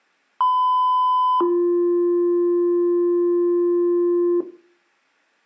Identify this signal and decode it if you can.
Two-tone page, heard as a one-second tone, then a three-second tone, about 1010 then 350 Hz.